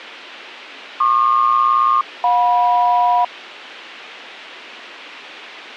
Aircraft SELCAL, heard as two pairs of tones. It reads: PQ-JM